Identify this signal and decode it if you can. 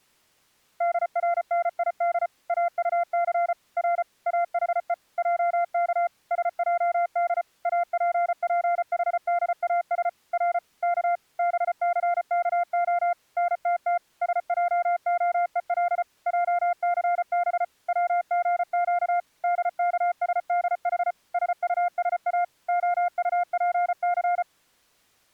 Morse code (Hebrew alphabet), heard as a keyed tone, machine-sent, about 34 wpm, 700 Hz. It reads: דרניד אטס ר אחו עך שעד אפפחדאש ר כ בסכה נתת שעהול עסב צגק דכשדח שטשא הטפס